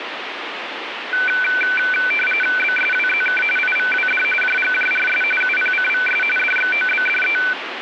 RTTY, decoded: BSWZK IVWD JGJRS UPCVS DXOBDE

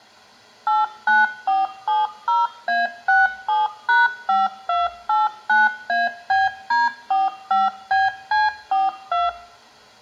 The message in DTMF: 89470A67#5289ABD45BC42

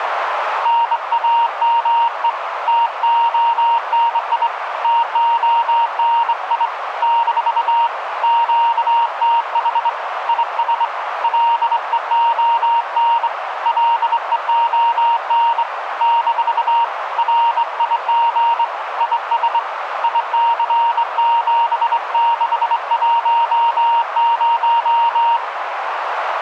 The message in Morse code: NAME TONI TONI - QTH IS LEON LEON - RIG IS IC7610

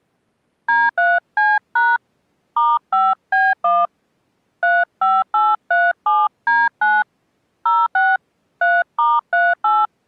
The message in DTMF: D3C# *5B1 35837D9 06 3*38

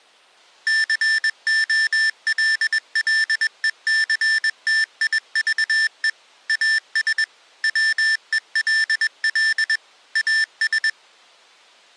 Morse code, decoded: COLLECTIVE AS WELL AS

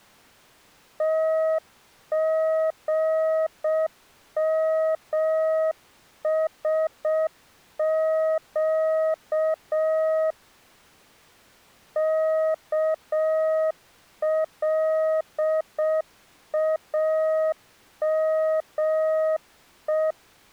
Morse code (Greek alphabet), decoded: ΤΓΜΣΨ ΚΛΑΜΕ

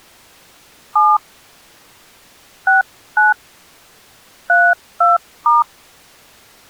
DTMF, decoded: 7 69 32*

